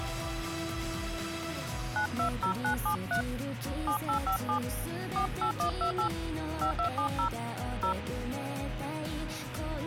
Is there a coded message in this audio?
Yes: DTMF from 2.0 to 7.9 s, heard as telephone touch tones, dialled by hand, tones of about 100 ms, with radio hiss. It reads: 920973 7857 48128 5270 0